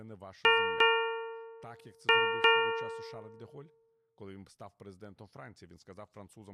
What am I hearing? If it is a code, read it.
Ship's bell, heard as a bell, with speech in Ukrainian. 4. Four half-hours of the watch have passed.